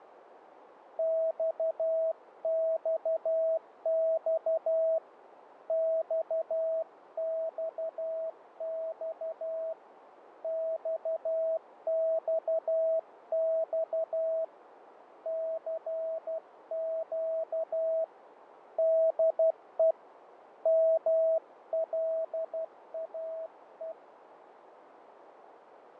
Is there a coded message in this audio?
Yes: Morse code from 0.9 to 24.0 s, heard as a keyed tone, hand-sent with a paddle, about 12 wpm, 650 Hz, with radio static, fading and a narrow filter. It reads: XXX XXX XXX CQ DE MLAE